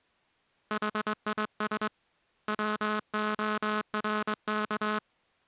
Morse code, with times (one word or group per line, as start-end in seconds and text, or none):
0.7-1.9 HIS
2.5-5.0 WORK